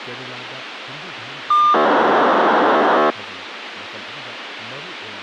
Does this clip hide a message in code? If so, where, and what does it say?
Yes: POCSAG pager data (2400 baud) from 1.5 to 3.1 s, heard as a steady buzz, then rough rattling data, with radio hiss and speech in Manipuri.